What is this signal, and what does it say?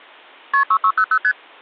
Multi-frequency trunk signalling (R1, as on North American trunks), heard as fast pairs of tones, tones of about 70 ms. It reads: KP 6600 ST